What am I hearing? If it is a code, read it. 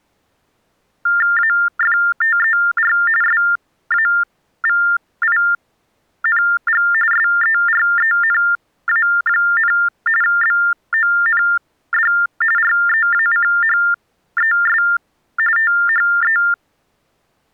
TTY/TDD text telephone tones (45.45 baud Baudot), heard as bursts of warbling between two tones, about 400 Hz shift, 1600 Hz centre. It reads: AFTER SAVING SERENA, BOND REACHES THE